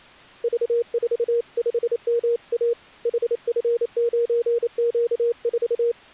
Morse code, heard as a keyed tone, hand-sent with a paddle, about 28 wpm, 470 Hz. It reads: V45MA HF9Q4